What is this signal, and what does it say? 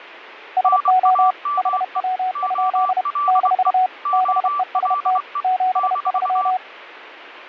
Morse code, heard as two keyed tones. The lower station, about 31 wpm, 740 Hz: SO HW? - BEST 73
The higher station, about 24 wpm, 1160 Hz: NAME OLE OLE -